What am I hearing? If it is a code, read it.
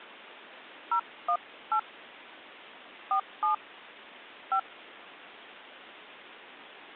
DTMF, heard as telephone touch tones, dialled by hand, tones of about 100 ms. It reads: 018 47 5